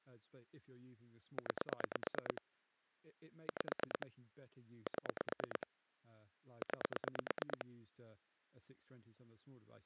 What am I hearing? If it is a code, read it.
Pulse dialling, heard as clicks on a phone line, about 9 pulses a second, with speech in English. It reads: 9 5 7 9